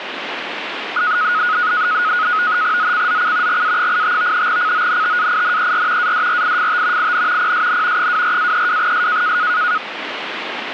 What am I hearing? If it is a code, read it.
NAVTEX (SITOR-B), 100 baud, 170 Hz shift, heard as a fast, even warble, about 1360 Hz centre, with radio static. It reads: ZCZC GA85 CONTAINER ADRIFT IN PSN 24-32S